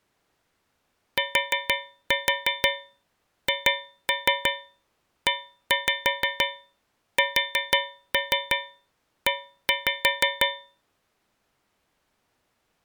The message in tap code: THESE

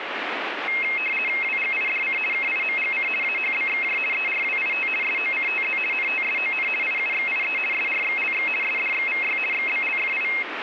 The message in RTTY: WGIDC KIMGC AHBXJ ERWIT SOCTZ NTSON IUXIE SRXLX SDXVY XBLFI

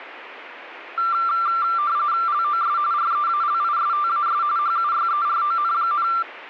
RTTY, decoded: LOS REALISTAS HUYERON,

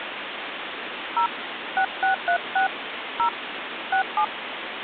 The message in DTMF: 0 6636 0 67

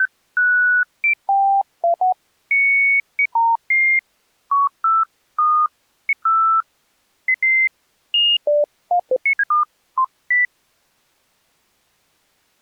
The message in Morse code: none

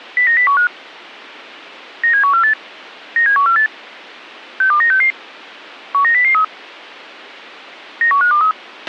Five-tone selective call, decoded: 09015 97148 97148 62966 19003 91523

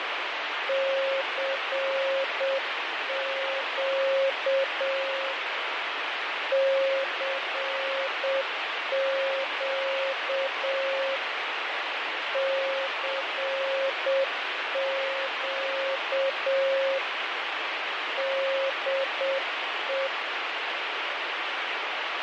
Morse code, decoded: CQ CQ CQ DE

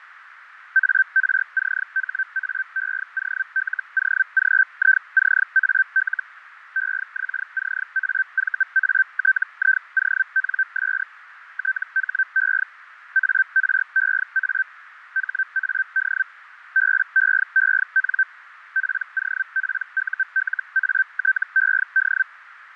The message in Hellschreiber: ARCHAEOLOGICAL EXCAVATIONS THE AREA HAD BEEN POPULATED

